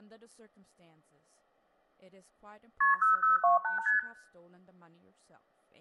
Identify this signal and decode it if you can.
Multi-frequency trunk signalling (R1, as on North American trunks), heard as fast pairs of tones, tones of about 140 ms, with room echo and speech in English. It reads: KP 0028 ST